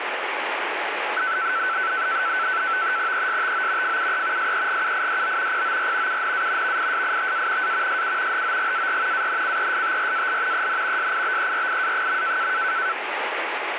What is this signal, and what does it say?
NAVTEX (SITOR-B), 100 baud, 170 Hz shift, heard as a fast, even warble, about 1420 Hz centre, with radio static. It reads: ESTO FUE SEGUIDO POR UNA VISITA A SU HOGAR ANCESTRAL EN SIBERIA.